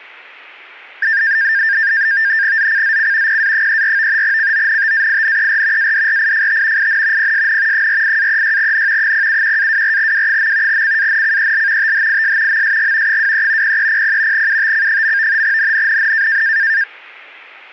NAVTEX (SITOR-B), 100 baud, 170 Hz shift, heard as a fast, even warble, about 1700 Hz centre. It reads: ZCZC PA34 CONTAINER ADRIFT IN PSN 48-36N 071-24W. CANCEL THIS MSG 23 0300 UTC. NNNN